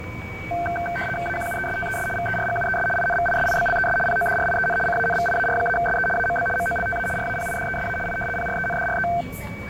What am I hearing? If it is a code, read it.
RTTY (75 baud, 850 Hz shift), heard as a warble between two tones, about 1120 Hz centre, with radio static, static crashes, a steady whistle near 2270 Hz and the noise inside a subway train. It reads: AQUESTES VERGUES INVISIBLES PODRIEN CANVIAR-SE AMB MOLTA RAPIDESA I PRENDRE